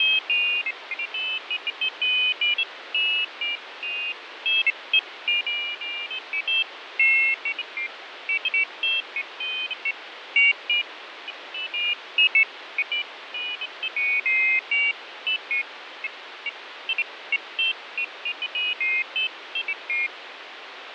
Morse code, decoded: none

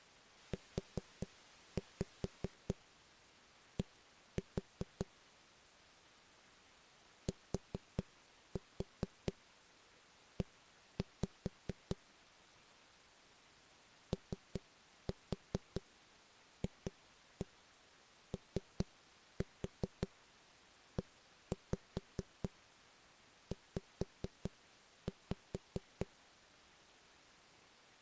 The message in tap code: UD TE OFOEZ

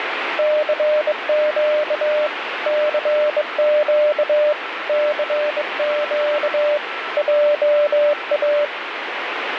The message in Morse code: CQ CQ CQ JA

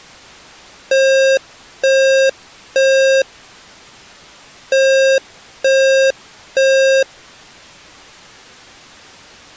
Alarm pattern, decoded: temporal three

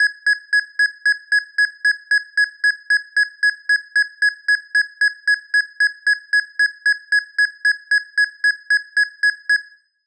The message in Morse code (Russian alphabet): none

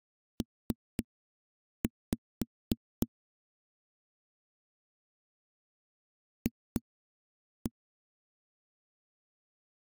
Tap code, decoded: P F

